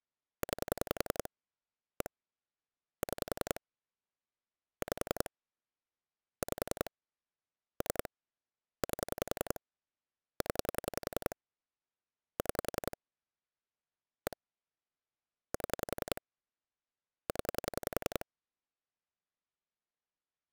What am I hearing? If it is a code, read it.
Pulse dialling, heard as clicks on a phone line, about 10 pulses a second. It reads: 9 1 6 5 5 3 8 0 6 1 7 0